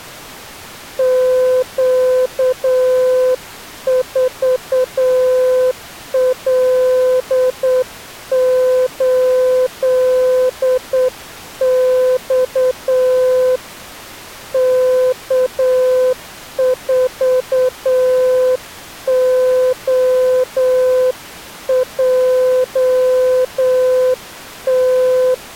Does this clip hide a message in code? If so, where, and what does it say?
Yes: Morse code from 0.9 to 25.4 s, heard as a keyed tone, hand-sent with a straight key, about 8 wpm, 510 Hz. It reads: Q4L8X K4OJT